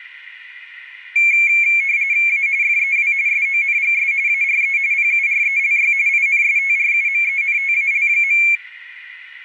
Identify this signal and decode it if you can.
RTTY (45.45 baud, 170 Hz shift), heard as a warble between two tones, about 2250 Hz centre. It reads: A FEW SONGS ARE PURELY INSTRUMENTAL.